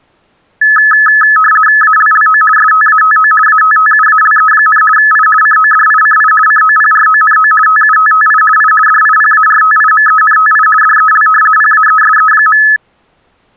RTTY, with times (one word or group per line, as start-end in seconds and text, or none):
1.8-2.4 ALLO
2.6-3.3 STATO
3.5-4.8 ATTUALE,
5.0-5.3 I
5.4-6.3 CODICI
6.5-7.5 COPRONO
7.7-8.4 TUTTI
8.6-8.7 I
8.9-10.7 DIPARTIMENTI
10.8-11.3 DEL
11.6-12.6 PAESE.